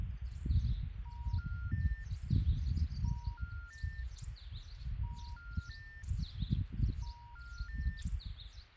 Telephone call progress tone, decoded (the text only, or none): special information tone